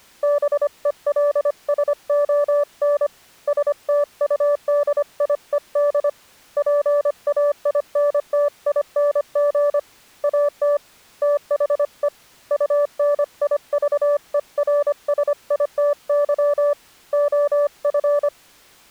Morse code, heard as a keyed tone, hand-sent with a paddle, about 25 wpm, 580 Hz. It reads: BELSON STUDIED PAINTING AT THE UNIVERSITY OF